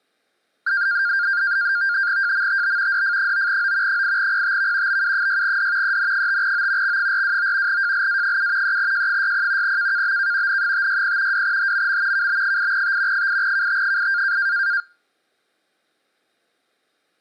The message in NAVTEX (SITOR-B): JMTB DF9O 8PTV BU6D EN5O X429 JLA7 3J60 KKBK N560 2HMM KB8T 8KT8

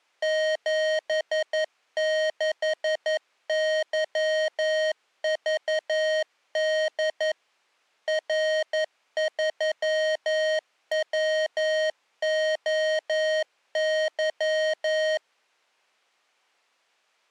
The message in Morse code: 76YVD R3WOY

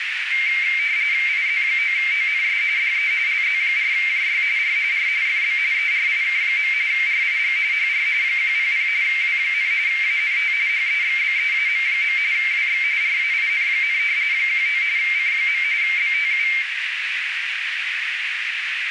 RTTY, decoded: IZ9ONS DE LZ4JY R R FB ERIK. RIG HR 100 W, ANT HEXBEAM. WX RAIN, 19 C. BTU

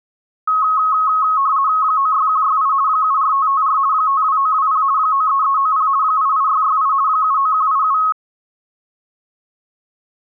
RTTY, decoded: 96168 74554 52920 93390 88668 79187

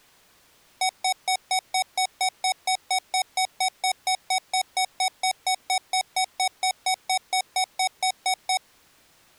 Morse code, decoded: none

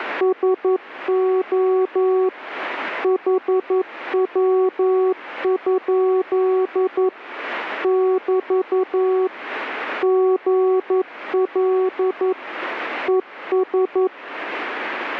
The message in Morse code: SO HW? <BT> GL ES

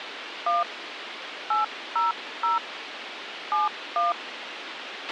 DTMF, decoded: 1 800 71

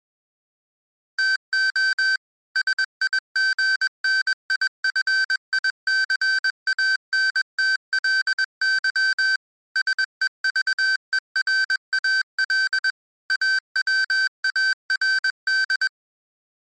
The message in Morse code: TO SIGNIFICANTLY SEVERAL AWARD

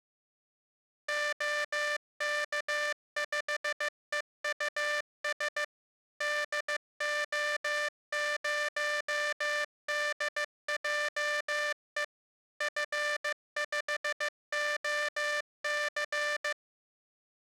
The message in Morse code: OK5EUS DO0DJE F5OC

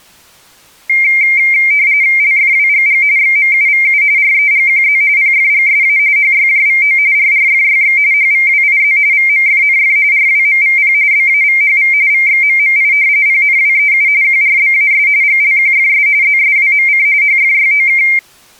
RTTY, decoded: LFWGG XMUVU REGQZ PFGSA HYJVO RRFYX HVWIZ VMFNF RWMVP BAVHV VXMMI PNWEU QRBAS GLQFS ZSWMC HFYOK

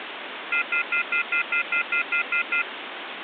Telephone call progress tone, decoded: off-hook warning tone

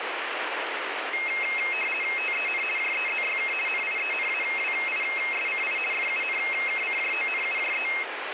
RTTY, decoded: TEN JEZYK NIENAWISCI FUNKCJONUJE

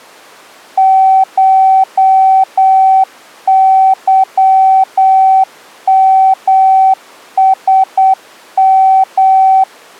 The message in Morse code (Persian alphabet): شظمسم

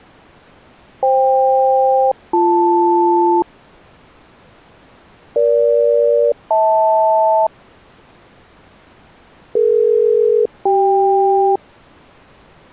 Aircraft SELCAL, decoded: FK-BL EG-HL DE-CK

